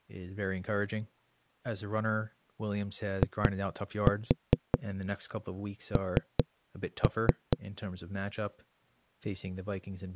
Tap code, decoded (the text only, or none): IN